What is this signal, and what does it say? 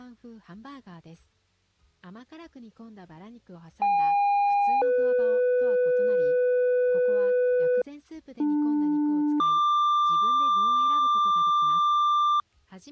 Two-tone page, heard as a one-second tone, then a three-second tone, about 810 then 500 Hz, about 300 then 1180 Hz.